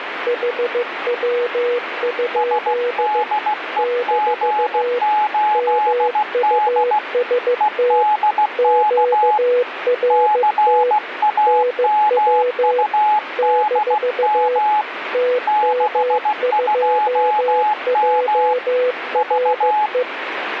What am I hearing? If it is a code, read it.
Morse code, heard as two keyed tones, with radio static. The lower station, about 15 wpm, 490 Hz: HW? - MUST QRT NW - TM2JRE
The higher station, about 16 wpm, 850 Hz: SDEG8D EDK CAMUDM 62M V